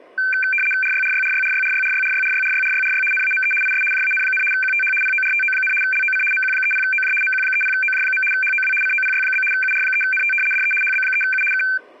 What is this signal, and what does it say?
RTTY (75 baud, 850 Hz shift), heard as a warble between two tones, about 1950 Hz centre. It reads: RYRYRYRYRYRYRYRYRYRYRY NAME IS JAN, QTH PORTO, LOC MQ30OJ MQ30OJ. HOW COPY? UR3NT DE HB3U K